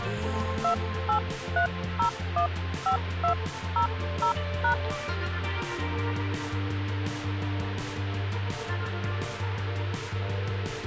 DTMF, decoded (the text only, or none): 283015200#